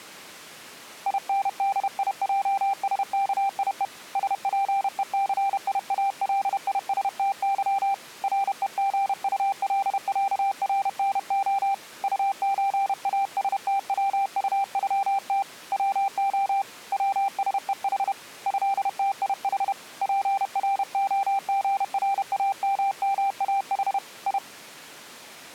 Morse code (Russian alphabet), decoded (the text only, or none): ИНДИЙСКИЕ СПЕЦИАЛИСТЫ РЕГУЛЯРНО УЧАСТВУЮТ ВО ВСЕХ ЭТИХ ПРОГРАММАХ И